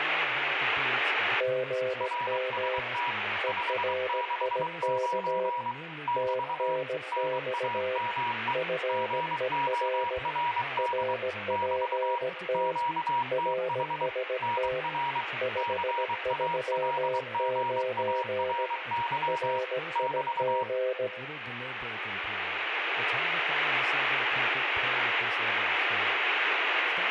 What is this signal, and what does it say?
Morse code, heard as two keyed tones, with radio static, room echo and speech in English. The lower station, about 17 wpm, 510 Hz: GM ERIK TNX FER RPT RST 539 RIG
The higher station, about 23 wpm, 960 Hz: RST 569 <BT> NAME GORD <BT> QTH NR CALGARY <BT>